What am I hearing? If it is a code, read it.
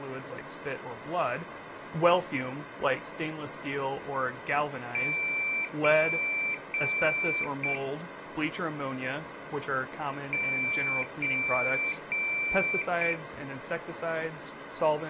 Beep code, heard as a piezo beeper, played twice, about 2350 Hz, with speech in English. 3 long, 1 short.